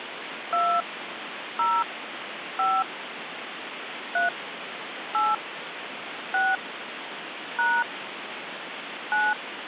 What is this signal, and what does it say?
DTMF, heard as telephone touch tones, dialled by hand, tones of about 200 ms, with phone line noise. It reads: 2 0 5 3 8 6 # 9